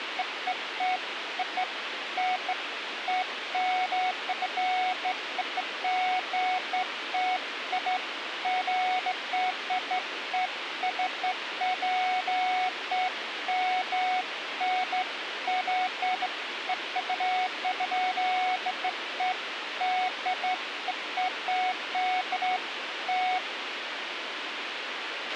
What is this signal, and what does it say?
Beeps of irregular length, with radio hiss and a squelch burst at the end. There is no code.